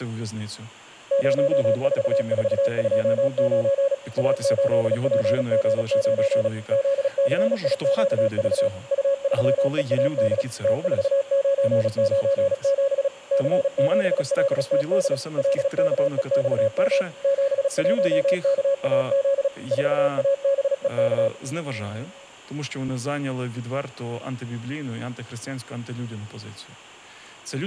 Morse code, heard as a keyed tone, machine-sent, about 36 wpm, 550 Hz, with speech in Ukrainian. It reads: 04429 A8PG9 ZCIQV U3EAD T4997 C7LTD LKEXM 71KAZ 4ABEK